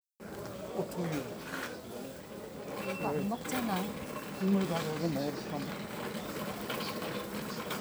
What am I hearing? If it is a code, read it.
The noise of a crowd indoors. There is no code.